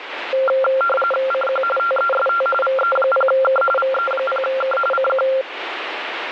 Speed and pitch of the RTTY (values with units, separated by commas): 45.45 baud, 850 Hz shift, 950 Hz centre